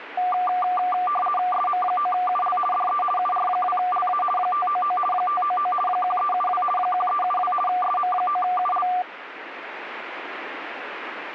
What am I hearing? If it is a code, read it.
RTTY (50 baud, 450 Hz shift), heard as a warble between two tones, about 950 Hz centre, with radio static. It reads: SM9UL DE UR2LA 599 599 1372 1372 SM9UL